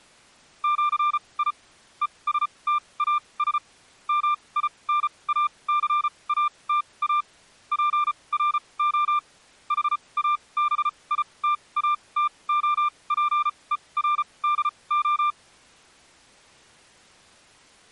Morse code (with Esperanto letters), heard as a keyed tone, machine-sent, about 34 wpm, spaced as for 24 wpm, 1190 Hz. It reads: ĜI ESTAS MINACATA PRO HABITATOPERDO